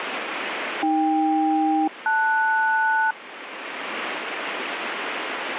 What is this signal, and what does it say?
Aircraft SELCAL, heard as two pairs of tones, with radio static. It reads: AK-LS